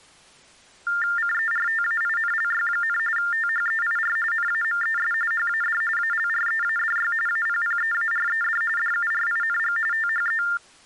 TTY/TDD text telephone tones (45.45 baud Baudot), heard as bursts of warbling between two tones, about 400 Hz shift, 1600 Hz centre. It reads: CERTAINLY, THEIR NAMES HAD ALREADY APPEARED DURING THE